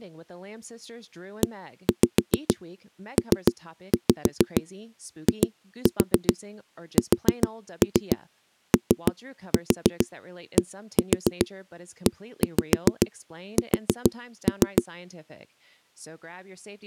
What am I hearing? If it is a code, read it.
Tap code, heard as knocks on a wall, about 6 knocks a second, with speech in English. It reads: EPISODES